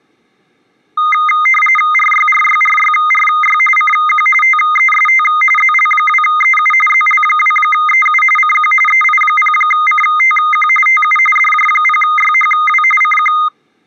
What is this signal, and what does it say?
RTTY (45.45 baud, 850 Hz shift), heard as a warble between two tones, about 1650 Hz centre. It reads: RYRYRYRY CQ TEST ZL2EU ZL2EU CQ EI0CTQ TU DJ0YHW CQ